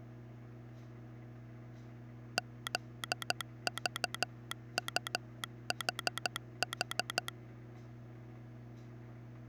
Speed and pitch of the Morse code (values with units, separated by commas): 13 wpm